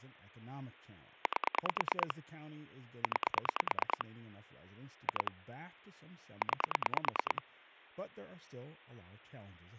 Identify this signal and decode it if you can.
Pulse dialling, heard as clicks on a phone line, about 9 pulses a second, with speech in English. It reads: 8 9 2 9